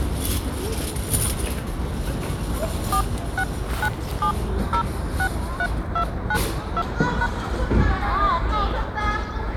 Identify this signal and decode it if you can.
DTMF, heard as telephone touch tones, dialled by hand, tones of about 70 ms, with the noise of a residential street. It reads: 4697063292#